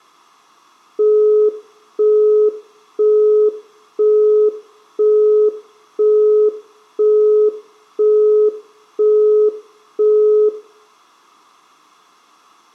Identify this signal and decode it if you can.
Telephone call progress tone (single-tone plan, as in Europe, Japan and elsewhere), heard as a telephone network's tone, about 420 Hz, 0.5 s on and 0.5 s off, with room echo. Busy tone.